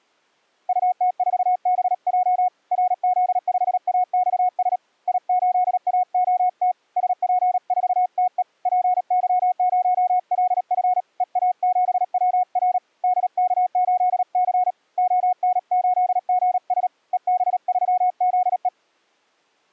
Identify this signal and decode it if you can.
Morse code, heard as a keyed tone, hand-sent with a paddle, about 37 wpm, 730 Hz. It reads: UT4BJ RZ5AXS I8AOT SP4TE PY0LF EA7WR DK8C ON8GS EB3ZE